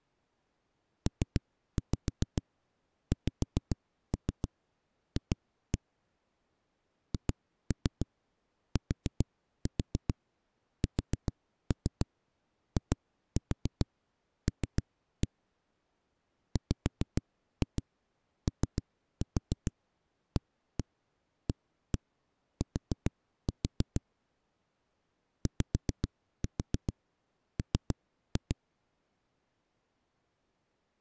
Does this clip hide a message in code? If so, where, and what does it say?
Yes: tap code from 1.1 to 28.5 s, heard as knocks on a wall, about 7 knocks a second. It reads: PXF HTSIL WOAAT YM